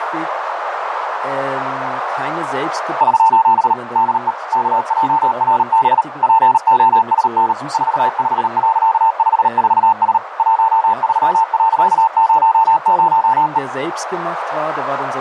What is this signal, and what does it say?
Morse code, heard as a keyed tone, machine-sent, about 38 wpm, 900 Hz, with radio static, a narrow filter and speech in German. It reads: <SOS> DE KJRB POSN 45.54S 13.00E